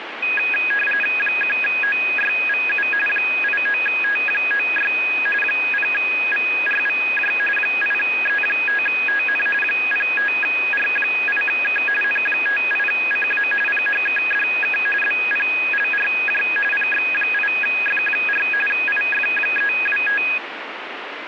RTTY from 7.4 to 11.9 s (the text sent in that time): 8E5TN 05R8K